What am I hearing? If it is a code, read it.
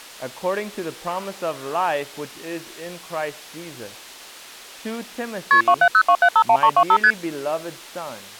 Multi-frequency trunk signalling (R1, as on North American trunks), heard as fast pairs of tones, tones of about 70 ms. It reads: KP 2702751325 ST